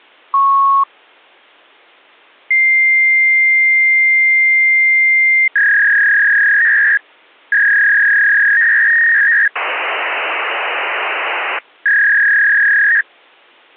Fax machine handshake, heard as a beep, a long tone, a warble and hiss.